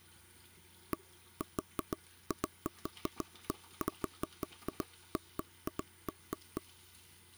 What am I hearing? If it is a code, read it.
Irregular taps on a table, with the noise of a restroom. There is no code.